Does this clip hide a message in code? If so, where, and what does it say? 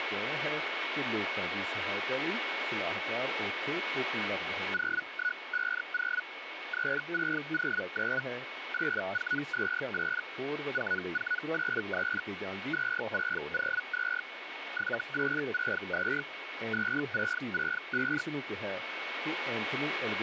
Yes: Hellschreiber (Feld-Hell, 122.5 baud) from 4.7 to 18.2 s, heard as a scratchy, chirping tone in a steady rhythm, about 1470 Hz, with radio static and a steady whistle near 2210 Hz. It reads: 0150 3609 8428 4483 2602 7862 2665